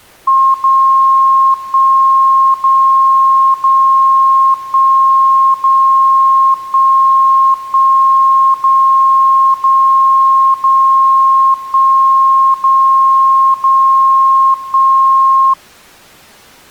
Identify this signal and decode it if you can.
Radio time signal (DCF77), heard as a tone whose level steps once a second, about 1070 Hz. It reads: 0 1 0 0 1 0 1 1 0 0 0 1 0 0 1